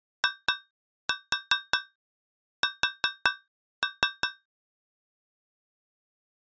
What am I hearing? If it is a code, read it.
Tap code, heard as taps on a metal pipe, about 5 knocks a second. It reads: IS